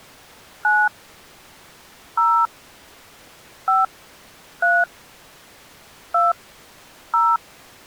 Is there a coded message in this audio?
Yes: DTMF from 0.6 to 7.4 s, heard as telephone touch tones, dialled by hand, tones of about 220 ms. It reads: 9 0 5 3 2 0